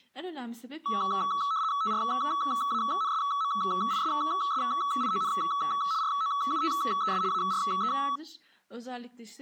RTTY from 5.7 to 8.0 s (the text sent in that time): ROUTES ARE